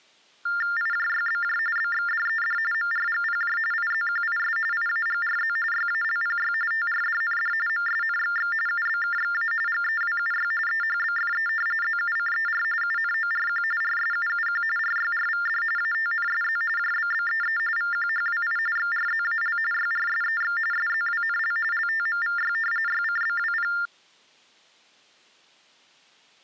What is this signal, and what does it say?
TTY/TDD text telephone tones (45.45 baud Baudot), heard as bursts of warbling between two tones, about 400 Hz shift, 1600 Hz centre. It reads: IJYBJ BXDED MRGPJ IZQIS IAGRZ YALPY TRDND MSNXX UBKXA GEWUY EHBFE ZUCER UNORQ RSUUQ RYRVD ATNSZ JBBEE VQHWI XRZAL YRSEX SZWNL LTMVY YCBWP